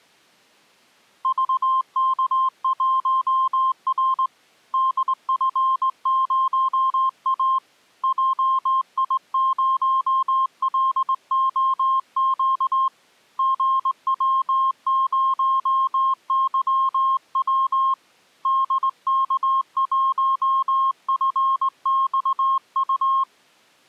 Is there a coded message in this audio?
Yes: Morse code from 1.2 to 23.3 s, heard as a keyed tone, hand-sent with a straight key, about 19 wpm, 1060 Hz. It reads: VK1R DF0A JI0LOQ GW0YW DK1FXU